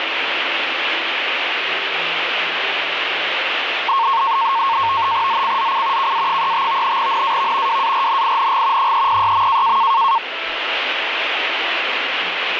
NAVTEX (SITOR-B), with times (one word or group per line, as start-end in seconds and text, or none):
5.3-6.1 ZCZC
6.0-7.0 KA35
7.0-7.8 NAV
7.7-8.9 WARNING
8.8-9.8 306.